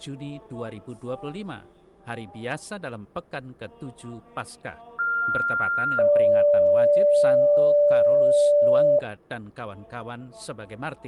Two-tone page, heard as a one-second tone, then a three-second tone, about 1400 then 580 Hz.